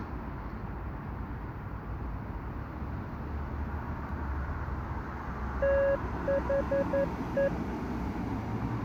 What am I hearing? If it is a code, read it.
Morse code, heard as a keyed tone, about 11 wpm, 550 Hz, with street noise. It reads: THE